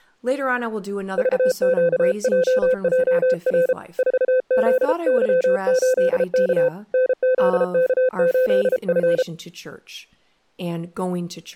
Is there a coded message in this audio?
Yes: Morse code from 1.1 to 9.3 s, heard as a keyed tone, hand-sent with a paddle, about 33 wpm, 510 Hz, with speech in English. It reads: VQJJR 4ZY8K NZK8F